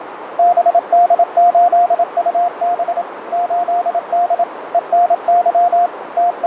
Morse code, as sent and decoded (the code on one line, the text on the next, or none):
-... -.. ---.. ..- -... / ---.. -.. / . -. -.-- / …
BD8UB 8D ENY …